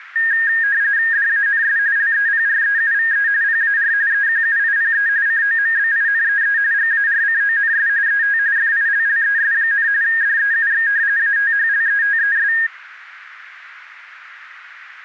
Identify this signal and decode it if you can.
RTTY (45.45 baud, 170 Hz shift), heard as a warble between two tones, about 1750 Hz centre. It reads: DANS LEPREUVE PAR EQUIPE COMBINEE GARCONS ET FILLES, DEUX ATHLETES